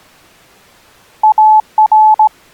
Morse code, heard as a keyed tone, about 18 wpm, 860 Hz. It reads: AR